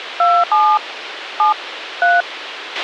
DTMF, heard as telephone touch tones, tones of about 220 ms, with radio hiss and a squelch burst at the end. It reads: 27 7 3